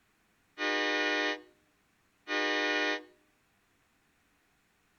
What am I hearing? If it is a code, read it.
Train horn signal, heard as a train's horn, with room echo. 2 short. On North American railways: a signal is acknowledged.